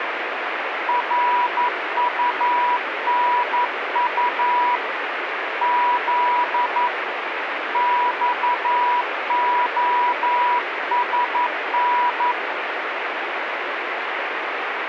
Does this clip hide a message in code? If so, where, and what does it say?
Yes: Morse code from 0.8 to 12.4 s, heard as a keyed tone, hand-sent with a paddle, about 11 wpm, 980 Hz, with radio static. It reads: RUNU Z XOSN